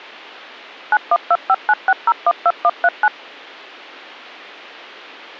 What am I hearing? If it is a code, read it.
DTMF, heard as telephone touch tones, dialled by machine, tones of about 50 ms. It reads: 912596012139